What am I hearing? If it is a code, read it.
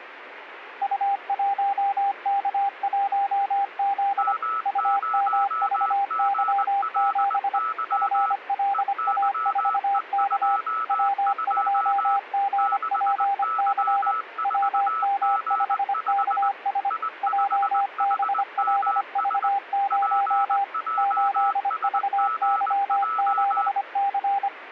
Morse code, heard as two keyed tones, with radio static. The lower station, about 25 wpm, 800 Hz: U1K1Z UMVY7 FLA4K W2GPC WM5KS JBLV0 8VY7C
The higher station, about 20 wpm, 1300 Hz: M0GLY EYE22 6Y4G5 I5HMS PJSGJ